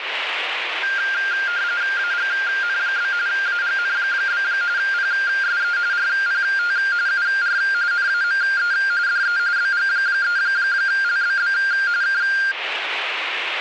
RTTY (45.45 baud, 170 Hz shift), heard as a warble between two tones, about 1500 Hz centre, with radio static. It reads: AGN? AGN? PSE RPT UR NAME DE BG3LBB K